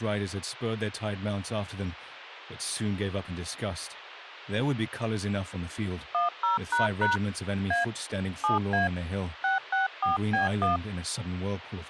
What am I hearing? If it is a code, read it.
DTMF, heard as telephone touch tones, dialled by hand, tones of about 140 ms. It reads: 10## A 7A 664B1